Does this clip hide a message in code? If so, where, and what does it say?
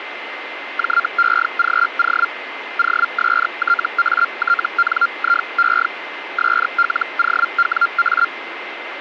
Yes: Hellschreiber (Feld-Hell, 122.5 baud) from 0.8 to 8.3 s, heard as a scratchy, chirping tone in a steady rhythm, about 1390 Hz, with radio static and a steady whistle near 2070 Hz. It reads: JEGO OSTATNIE SLOWA